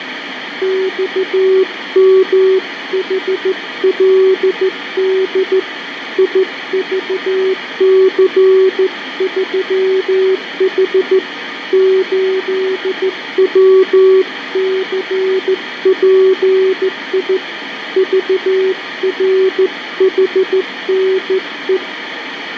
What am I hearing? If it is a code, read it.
Morse code, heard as a keyed tone, hand-sent with a straight key, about 14 wpm, 380 Hz, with radio static, fading and room echo. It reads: XMHLD IVC3H 8WCPI VRHNE